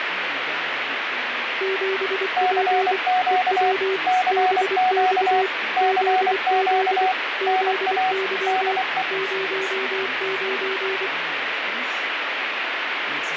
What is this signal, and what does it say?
Morse code, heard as two keyed tones, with radio static. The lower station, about 24 wpm, 380 Hz: 7P EW BX ZZ ZY 09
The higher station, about 24 wpm, 740 Hz: CQ CQ CQ NA DE